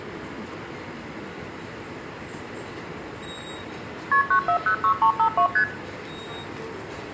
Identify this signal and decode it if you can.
Multi-frequency trunk signalling (R1, as on North American trunks), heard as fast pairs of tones, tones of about 90 ms, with the noise of a subway station. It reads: KP 9406352 ST